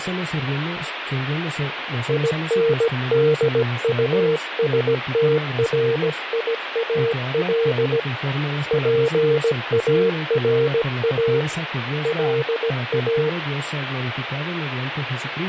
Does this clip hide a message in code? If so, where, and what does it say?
Yes: Morse code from 2.0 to 13.4 s, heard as a keyed tone, hand-sent with a paddle, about 17 wpm, 460 Hz, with radio static. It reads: INDUSTRIAL PARA LA